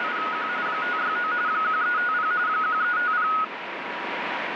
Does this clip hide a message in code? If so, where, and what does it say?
Yes: RTTY (45.45 baud, 170 Hz shift) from 0.0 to 3.4 s, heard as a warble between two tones, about 1360 Hz centre, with radio static. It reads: … 569 1350 1350